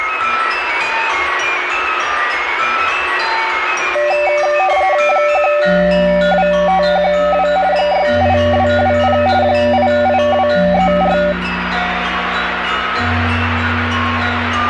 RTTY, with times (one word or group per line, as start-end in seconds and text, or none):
5.1-7.5 12512
7.7-9.2 68220
9.4-11.2 88234